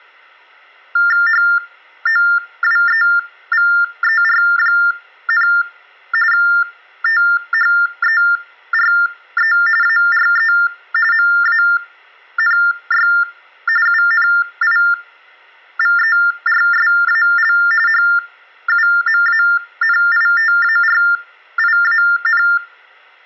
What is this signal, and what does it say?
TTY/TDD text telephone tones (45.45 baud Baudot), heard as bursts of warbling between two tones, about 400 Hz shift, 1600 Hz centre, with room echo. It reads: HOWEVER, THERE ARE MANY UNIVERSAL HUMANITARIAN